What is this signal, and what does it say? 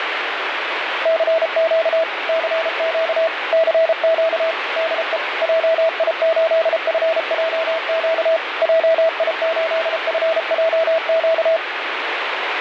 Morse code, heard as a keyed tone, machine-sent, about 33 wpm, 650 Hz, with radio static. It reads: CQ CQ CQ DE JI8FJQ JI8FJQ